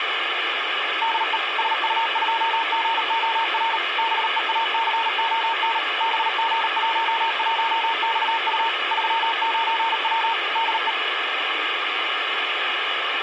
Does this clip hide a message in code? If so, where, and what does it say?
Yes: Morse code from 1.0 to 11.0 s, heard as a keyed tone, machine-sent, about 38 wpm, 910 Hz, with radio hiss. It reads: DE SU2GOR BEACON BG11XU 39W DE